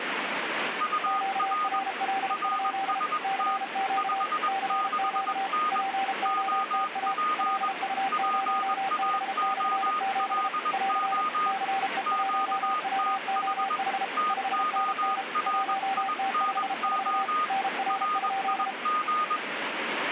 Morse code, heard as two keyed tones, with radio static. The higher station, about 21 wpm, 1230 Hz: UR RST 56N OP PAOLO QTH TORINO RIG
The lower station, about 33 wpm, 780 Hz: QRL? CQ CQ POTA LU0B/7 <AR> CE1WOH 5NN 1T54 NR?